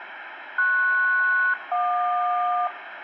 Aircraft SELCAL, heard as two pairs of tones, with radio static and room echo. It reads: PS-JQ